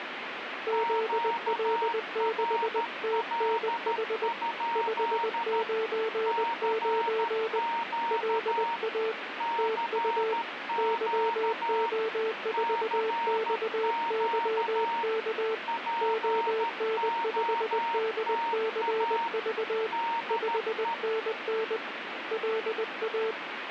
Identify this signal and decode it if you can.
Morse code, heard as two keyed tones, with radio static. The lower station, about 20 wpm, 440 Hz: ZL6TNH 599 LA TU YO4XYK ON5DCV 5NN LA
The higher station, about 13 wpm, 930 Hz: QRL? CQ CQ CQ POTA DE